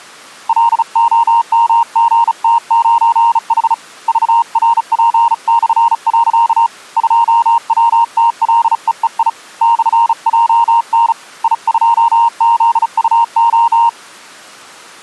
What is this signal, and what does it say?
Morse code, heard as a keyed tone, hand-sent with a bug key, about 35 wpm, 930 Hz. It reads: LOMGT9H VRP/. 2WTLEEI /JN I2ZUO